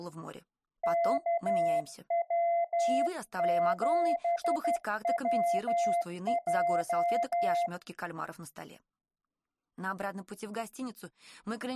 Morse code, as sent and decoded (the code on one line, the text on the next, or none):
-.- .-- --... .-- .---
KW7WJ